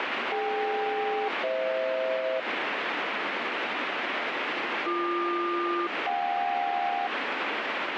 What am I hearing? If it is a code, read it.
Aircraft SELCAL, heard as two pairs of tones, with heavy radio static. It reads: DK-FH BQ-JK